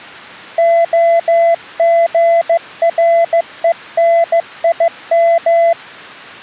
Morse code, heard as a keyed tone, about 15 wpm, 670 Hz. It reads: OGRENIM